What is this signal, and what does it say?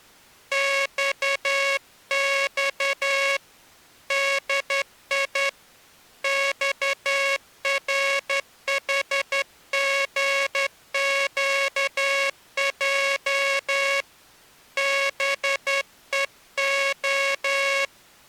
Morse code, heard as a buzzer, hand-sent with a straight key, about 11 wpm. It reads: XX DI XRHGQJ BEO